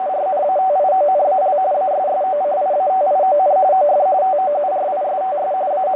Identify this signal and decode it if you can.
RTTY (45.45 baud, 170 Hz shift), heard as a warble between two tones, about 670 Hz centre, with radio static and a narrow filter. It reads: … ASSOCIATION OF TOURISTS …